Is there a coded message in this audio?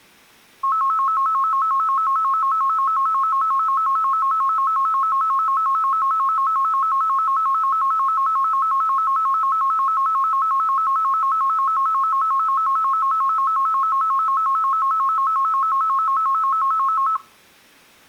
No, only a tone that alternates evenly between two pitches, with room echo.